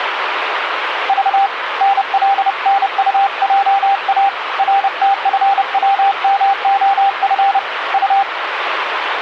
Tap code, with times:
none

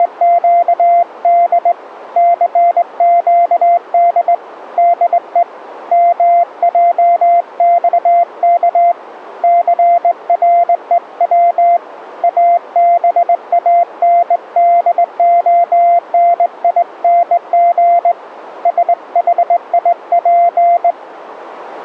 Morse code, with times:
0.0-1.7 …
2.2-4.3 CQD
4.8-5.4 DE
5.9-8.9 MJXK
9.4-11.8 CREW
12.2-18.1 ABANDONING
18.7-20.9 SHIP

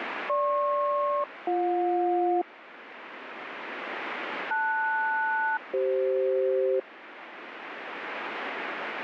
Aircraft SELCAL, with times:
0.3-2.4 GP-BJ
4.5-6.8 LS-CF

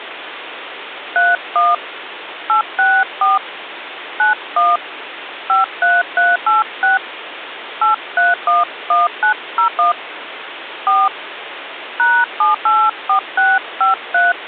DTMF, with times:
1.2-1.7 31
2.5-3.4 864
4.2-4.8 91
5.5-7.0 53386
7.8-9.9 8311901
10.9-11.1 4
12.0-14.3 #784653

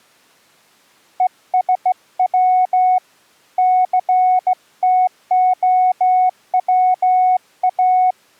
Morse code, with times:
1.2-3.0 ESW
3.6-8.1 CTOWA

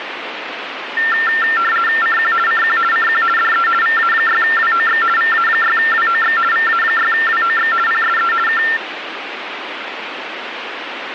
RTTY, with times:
2.0-2.3 CQ
2.5-2.8 CQ
2.9-3.2 CQ
3.4-3.7 DE
3.8-5.0 VA6WOX
5.2-6.4 VA6WOX
6.5-7.7 VA6WOX
7.9-8.3 PSE
8.5-8.6 K

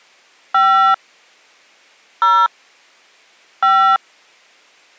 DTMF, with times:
0.5-0.9 5
2.2-2.5 0
3.6-4.0 5

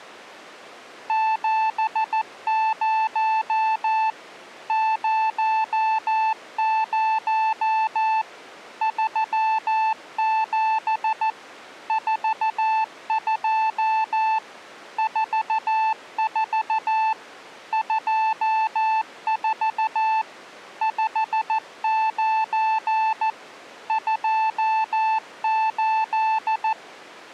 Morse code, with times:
1.1-4.1 70
4.7-8.2 00
8.8-11.3 37
11.9-14.4 42
15.0-17.1 44
17.7-20.2 24
20.8-23.3 59
23.9-26.7 28

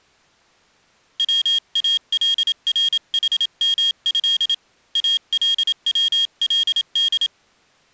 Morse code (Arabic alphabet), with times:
1.2-4.5 والرحمه
5.0-7.3 الولد

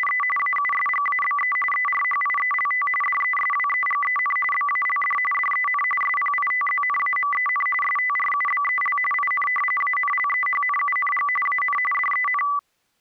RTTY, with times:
0.0-0.2 …
0.4-1.6 AUSGABE
1.7-2.9 ERHIELT
3.0-4.4 DESWEGEN
4.5-5.2 BALD
5.3-5.8 DEN
6.0-7.7 SPITZNAMEN
7.8-9.0 STRUBEL
9.1-9.5 IN
9.8-11.3 ANLEHNUNG
11.5-11.8 AN
11.9-12.4 DEN

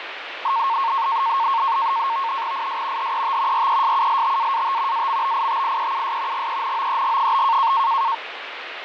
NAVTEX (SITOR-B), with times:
2.5-3.1 IS
3.0-3.7 HET
3.5-5.1 RESULTAAT
4.9-6.5 AMBITIEUS
6.3-7.7 GENOEG?

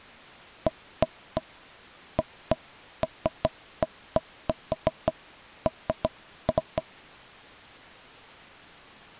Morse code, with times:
none

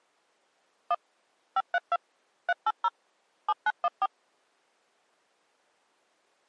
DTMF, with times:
0.9-0.9 1
1.6-2.0 532
2.5-2.9 380
3.5-4.1 7914

